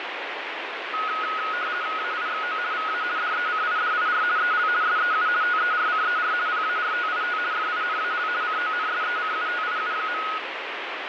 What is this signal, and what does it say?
RTTY (50 baud, 170 Hz shift), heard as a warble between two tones, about 1360 Hz centre, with radio static. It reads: AIXO VA DECIDIR EL SEU TERCER PARTIT FINAL CONSECUTIU.